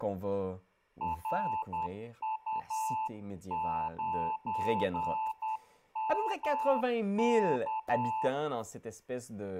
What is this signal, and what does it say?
Morse code, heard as a keyed tone, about 10 wpm, 880 Hz, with room echo and speech in French. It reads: RU9MK